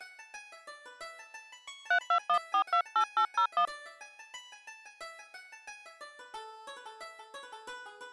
DTMF, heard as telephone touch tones, dialled by hand, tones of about 80 ms. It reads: 321428801